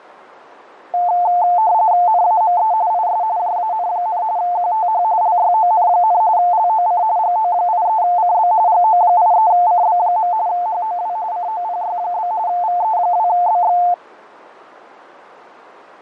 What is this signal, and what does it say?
RTTY (45.45 baud, 170 Hz shift), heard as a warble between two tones, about 790 Hz centre, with radio static and fading. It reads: NAME IS JAN, QTH LYON, LOC GO83CB GO83CB. HOW COPY? VE2BX